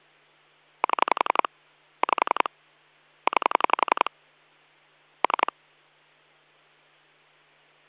Pulse dialling, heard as clicks on a phone line, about 11 pulses a second, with hum. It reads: 7 5 9 3